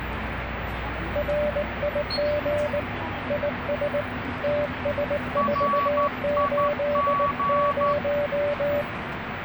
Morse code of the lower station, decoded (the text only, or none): RIG IS TS480